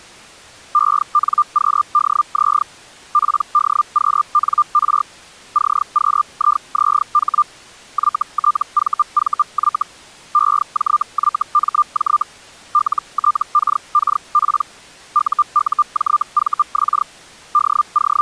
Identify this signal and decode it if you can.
Hellschreiber (Feld-Hell, 122.5 baud), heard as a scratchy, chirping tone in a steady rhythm, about 1200 Hz. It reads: ENQDZ PDQNR CQIZH YTVVY EJYMJ LTKKP UUJVX …